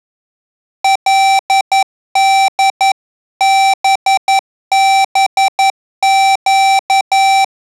Morse code (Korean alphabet), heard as electronic beeps, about 11 wpm, 780 Hz. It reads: 그때